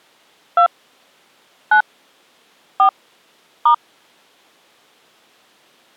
DTMF, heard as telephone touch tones, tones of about 90 ms. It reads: 2 9 4 *